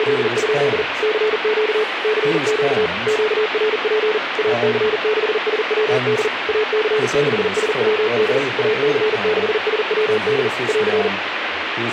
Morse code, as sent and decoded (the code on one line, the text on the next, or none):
… / -.-. --.- / -.-. --.- / --.- .-. .--. / .- -.-. -.... ... .-- -.. / .- -.-. -.... ... .-- -.. / .- -.-. -.... ... .-- -.. / .-.-.
… CQ CQ QRP AC6SWD AC6SWD AC6SWD <AR>